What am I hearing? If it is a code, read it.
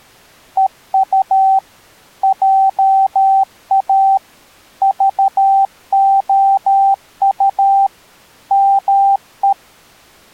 Morse code, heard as a keyed tone, machine-sent, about 13 wpm, 780 Hz. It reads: EU JA VOU ME